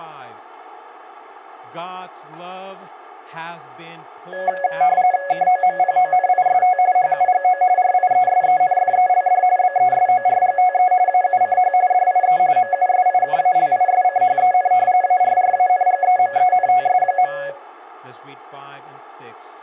RTTY (45.45 baud, 170 Hz shift), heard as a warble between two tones, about 650 Hz centre, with speech in English. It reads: KOMPONIST HUGO RIESENFELD BESORGTE AUCH DIE MUSIKALISCHEN ARRANGEMENTS.